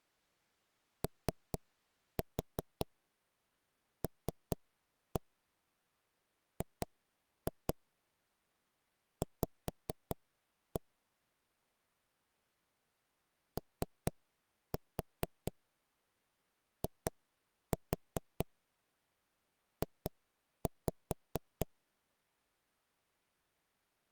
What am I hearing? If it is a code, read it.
Tap code, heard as knocks on wood, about 4 knocks a second. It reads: OLGV OIJ